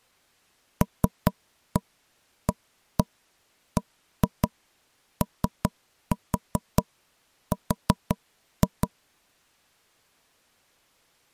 Tap code, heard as knocks on wood, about 5 knocks a second. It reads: LABOR